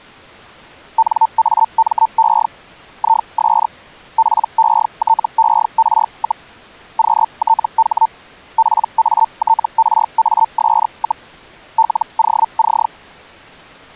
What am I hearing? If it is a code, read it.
Hellschreiber (Feld-Hell, 122.5 baud), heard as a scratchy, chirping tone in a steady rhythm, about 900 Hz. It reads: NAME IS PETER, QTH PATRAS, LOC